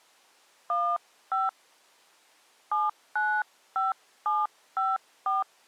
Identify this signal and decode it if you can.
DTMF, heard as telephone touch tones, dialled by hand, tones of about 190 ms. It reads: 15 795754